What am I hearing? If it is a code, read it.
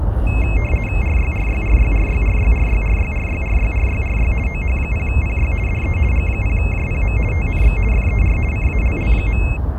RTTY (50 baud, 450 Hz shift), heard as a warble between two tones, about 2350 Hz centre, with the noise of a park. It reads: RYRYRYRYRYRYRYRYRYRYRY OH0PY DE G0JPM TNX FER CALL.